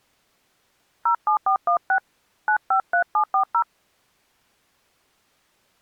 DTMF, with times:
1.1-2.0 07416
2.5-3.6 953740

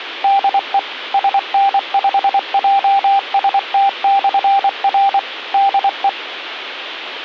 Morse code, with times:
0.2-0.8 DE
1.1-5.2 SN5JST/R
5.5-6.1 DE

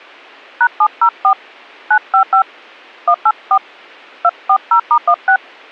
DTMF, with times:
0.6-1.3 #704
1.9-2.4 955
3.1-3.6 184
4.2-5.4 240*16

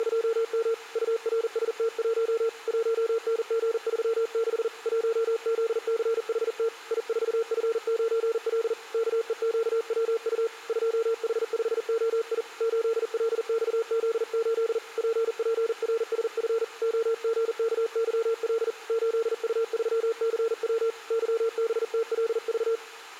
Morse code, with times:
0.0-0.7 …
1.0-2.5 URST1
2.7-4.7 1NG36
4.9-6.7 1ZCHT
6.9-8.7 I4F9L
8.9-10.5 KEQWU
10.7-12.4 2H5OI
12.6-14.8 8LXZ8
15.0-16.6 PPRSF
16.8-18.7 OGKYL
18.9-20.9 8U3CW
21.1-22.8 YBTLV

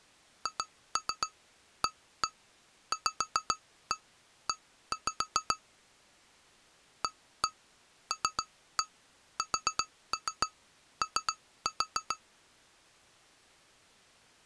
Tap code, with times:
0.5-5.6 HAVE
7.0-12.2 ALSO

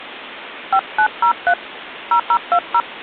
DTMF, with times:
0.7-1.5 5903
2.1-2.8 0020

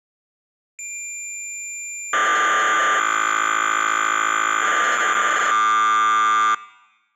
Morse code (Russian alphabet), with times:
none

